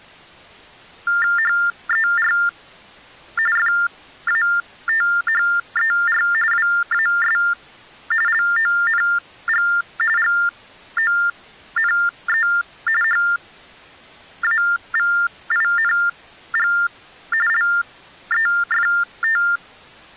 TTY/TDD text telephone tones (45.45 baud Baudot), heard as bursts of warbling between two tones, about 400 Hz shift, 1600 Hz centre. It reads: HER FATHER WAS LONG GONE HAVING LEFT